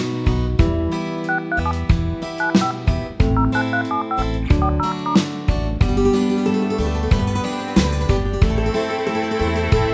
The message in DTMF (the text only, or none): 637 95 09375 40*